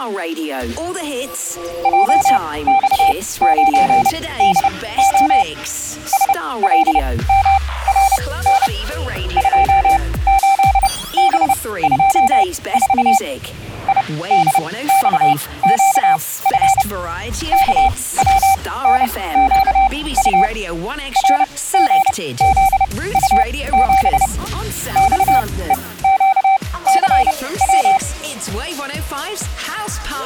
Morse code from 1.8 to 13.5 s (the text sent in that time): JX9DO SLMRN 28B24